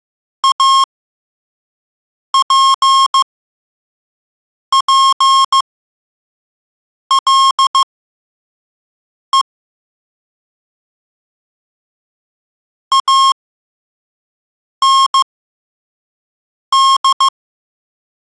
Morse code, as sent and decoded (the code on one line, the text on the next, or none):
.- .--. .--. .-.. . / .- -. -..
APPLE AND